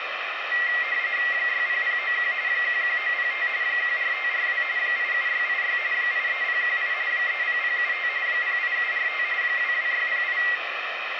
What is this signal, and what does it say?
RTTY (45.45 baud, 170 Hz shift), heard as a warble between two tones, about 2000 Hz centre, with radio static. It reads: 60091 11905 14542 87686 83018 30075 08745 22608